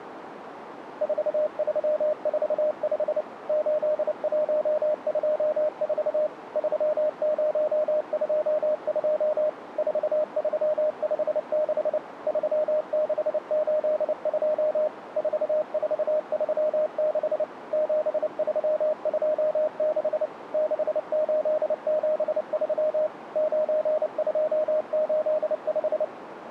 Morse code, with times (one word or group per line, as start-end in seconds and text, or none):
1.0-3.2 4345
3.5-6.3 8124
6.6-9.5 3022
9.8-12.0 4356
12.3-14.9 3682
15.2-17.4 4436
17.7-20.3 7326
20.5-23.1 6873
23.4-26.0 9285